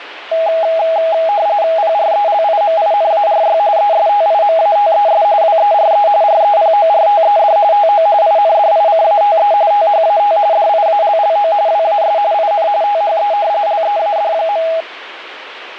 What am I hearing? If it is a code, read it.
RTTY (45.45 baud, 170 Hz shift), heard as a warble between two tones, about 740 Hz centre, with radio static. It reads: PRELIMINARY ESTIMATES WERE REPORTED TO INDICATE THAT DIALLO WAS IN THE LEAD.